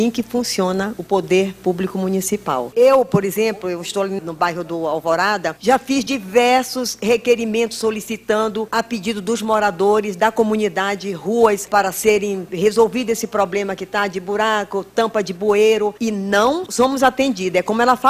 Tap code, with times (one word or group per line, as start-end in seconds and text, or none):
none